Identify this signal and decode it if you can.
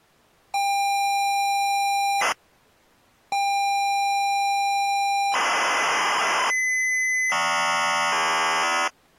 ZX Spectrum tape loading, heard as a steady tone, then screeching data.